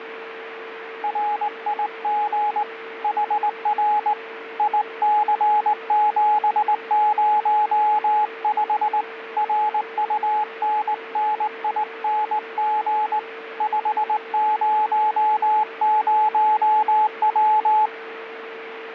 Morse code, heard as a keyed tone, hand-sent with a straight key, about 19 wpm, 850 Hz, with radio static and a steady whistle near 450 Hz. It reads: RIG HR IC705 RUNNING 500W